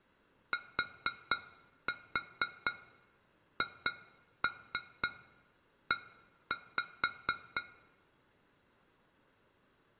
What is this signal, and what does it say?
Tap code, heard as taps on glass, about 4 knocks a second. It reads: THE